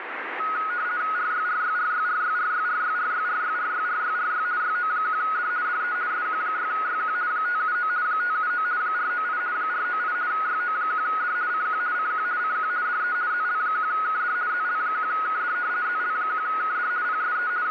RTTY (50 baud, 170 Hz shift), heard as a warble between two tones, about 1360 Hz centre, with radio static. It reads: RYRYRYRYRYRYRYRYRYRYRY YO1D DE SQ6YQ 579 579 498 498 YO1D CQ CQ CQ DE ZL1KD ZL1KD ZL1KD PSE …